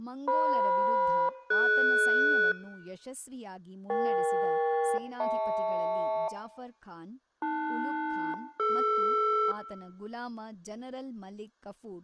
Aircraft SELCAL, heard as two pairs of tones, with speech in Kannada. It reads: FM-DS EK-HL AL-DR